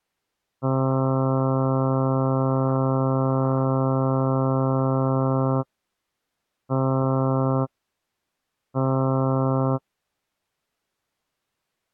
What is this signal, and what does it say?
Ship horn signal, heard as a ship's horn, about 130 Hz. 1 long, 2 short. At sea: a vessel in fog that is sailing, fishing, towing or hampered.